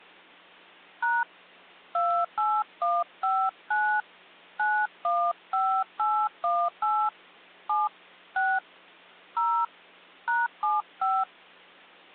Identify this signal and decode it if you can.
DTMF, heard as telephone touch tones, dialled by hand, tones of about 240 ms. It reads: # 28159 915818 7 6 0 #75